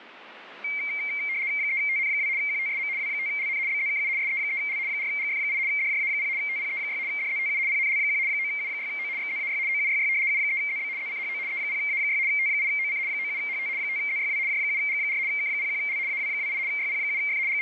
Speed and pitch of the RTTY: 75 baud, 170 Hz shift, 2200 Hz centre

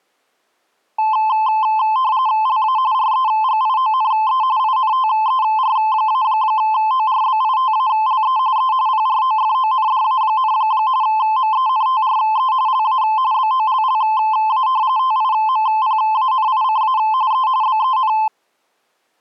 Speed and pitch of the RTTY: 45.45 baud, 170 Hz shift, 960 Hz centre

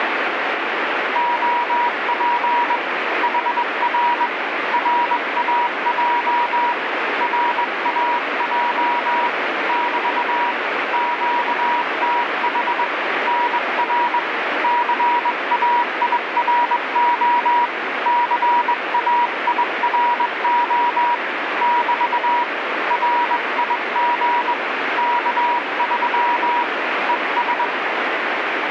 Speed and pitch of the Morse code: 21 wpm, 960 Hz

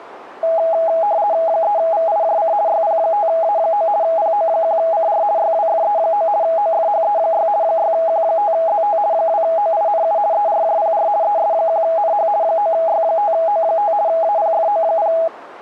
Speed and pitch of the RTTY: 50 baud, 170 Hz shift, 740 Hz centre

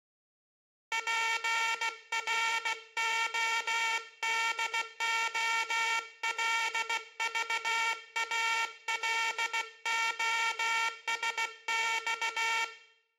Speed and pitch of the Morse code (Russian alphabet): 16 wpm

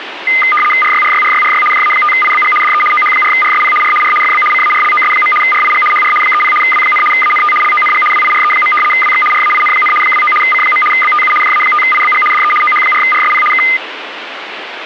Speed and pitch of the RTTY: 75 baud, 850 Hz shift, 1650 Hz centre

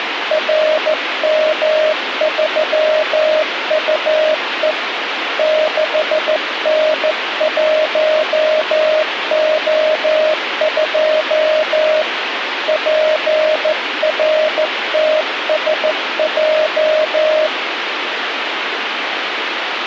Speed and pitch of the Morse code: 14 wpm, 620 Hz

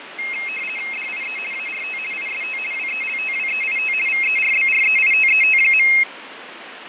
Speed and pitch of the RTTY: 50 baud, 450 Hz shift, 2350 Hz centre

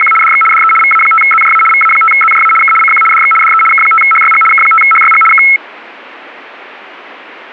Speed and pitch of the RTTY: 75 baud, 850 Hz shift, 1750 Hz centre

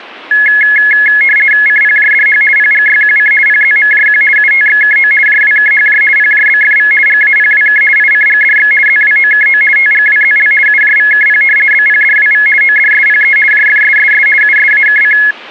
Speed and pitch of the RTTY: 50 baud, 450 Hz shift, 1900 Hz centre

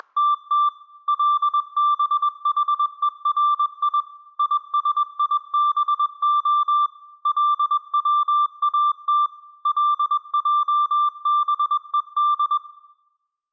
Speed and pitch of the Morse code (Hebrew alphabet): 21 wpm, 1180 Hz

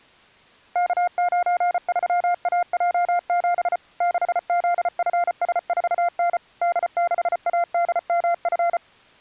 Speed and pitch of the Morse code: 34 wpm, 700 Hz

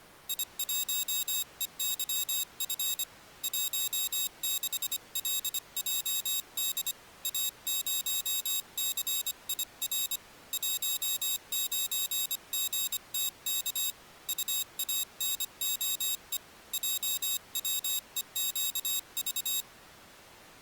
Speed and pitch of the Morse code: 25 wpm, 3750 Hz

